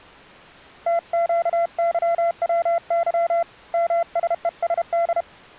Morse code (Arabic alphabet), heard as a keyed tone, hand-sent with a paddle, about 32 wpm, 680 Hz. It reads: تقظوظ مسءسد